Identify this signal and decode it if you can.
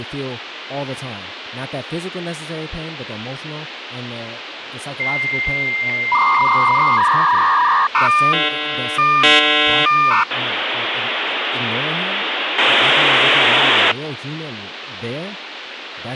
Dial-up modem handshake (V.34 or later), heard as a whistle, warbles, then hiss, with phone line noise and speech in English.